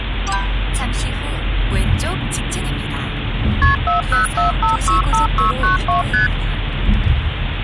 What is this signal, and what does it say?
Multi-frequency trunk signalling (R1, as on North American trunks), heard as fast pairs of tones, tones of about 130 ms, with phone line noise and the noise inside a car. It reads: KP 404565692 ST